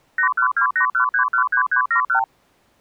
Multi-frequency trunk signalling (R2, with the far end's replies), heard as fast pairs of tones, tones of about 100 ms. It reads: 81281313371